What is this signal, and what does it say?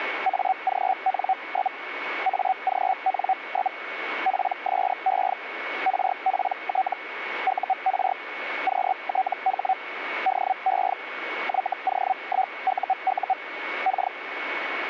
Hellschreiber (Feld-Hell, 122.5 baud), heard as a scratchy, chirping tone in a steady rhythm, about 760 Hz, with radio static and a steady whistle near 2220 Hz. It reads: AGN? AGN? PSE RPT UR QTH DE YO1UU K